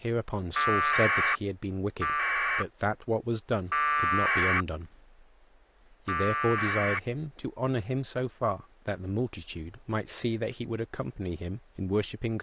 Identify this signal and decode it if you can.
Packet radio (AX.25, as in APRS), 1200 baud, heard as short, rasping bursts, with speech in English.